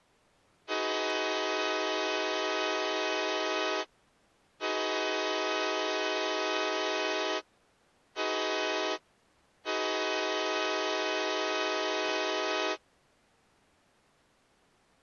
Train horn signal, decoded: 2 long, 1 short, 1 long

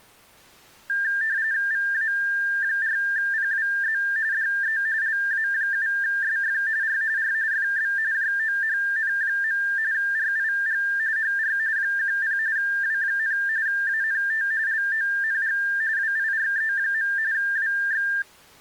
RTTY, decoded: VA4PWZ DE LA7SF R R FB JOHN. RIG HR 10 W, ANT LONG WIRE. WX

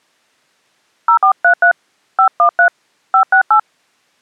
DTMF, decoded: 0433 513 568

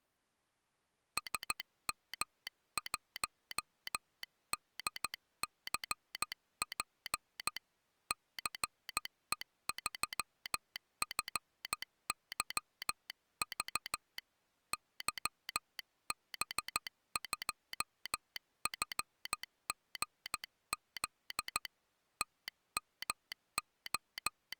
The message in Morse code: SM1DCP CE3FYV YB2FGZ …

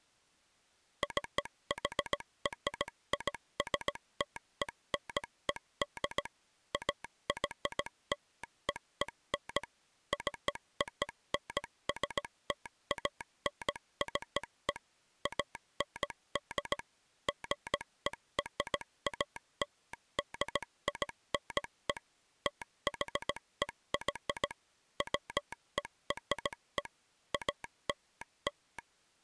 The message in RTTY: none

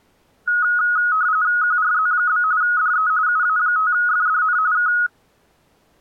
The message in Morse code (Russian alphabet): none

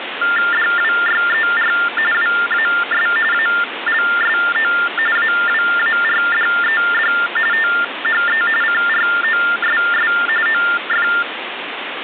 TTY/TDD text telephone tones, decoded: DWYER WAS ALSO AWARDED THE CROSS OF

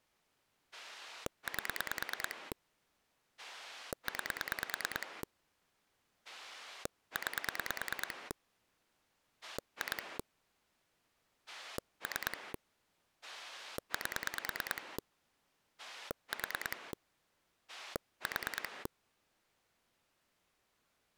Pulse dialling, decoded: 8 9 9 2 3 8 4 4

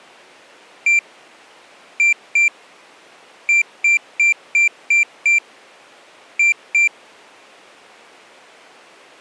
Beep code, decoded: 1-2-6-2

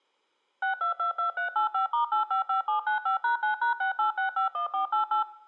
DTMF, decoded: 6222385*855795#9#68651488

